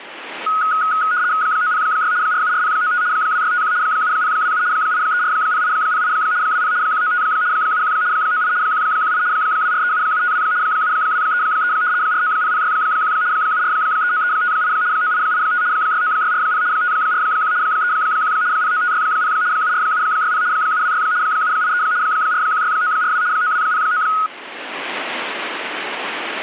RTTY (75 baud, 170 Hz shift), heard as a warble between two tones, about 1360 Hz centre. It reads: 906 474095 2651 7027 8340808 20 195 71 98 118 2437752 7233 490061 7439358 9885 69640 541 31 09560 74760 726 783 416942 9209